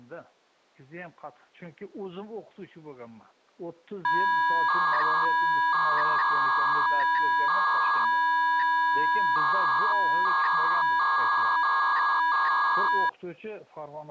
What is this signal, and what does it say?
300-baud modem data (V.21 tones), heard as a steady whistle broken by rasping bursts, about 300 baud, 200 Hz shift.